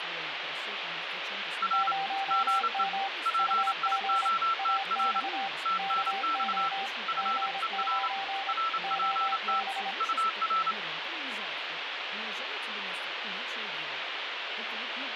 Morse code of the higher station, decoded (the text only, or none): R GE PIOTR TNX FER RPT UR